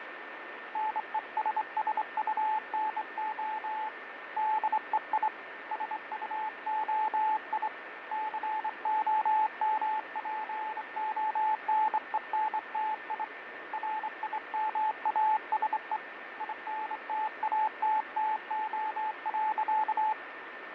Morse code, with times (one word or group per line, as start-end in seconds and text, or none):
0.8-3.9 NESSUNO
4.4-5.3 DEI
5.7-7.7 SUOI
8.1-13.2 COMPONENTI
13.7-16.0 RIMASE
16.4-20.1 INTATTO.